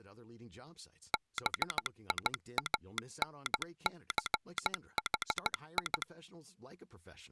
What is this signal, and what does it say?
Morse code, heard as a telegraph sounder, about 15 wpm, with speech in English. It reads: BIANCHI